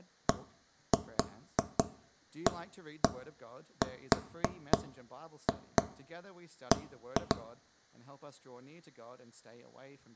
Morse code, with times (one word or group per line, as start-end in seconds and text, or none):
none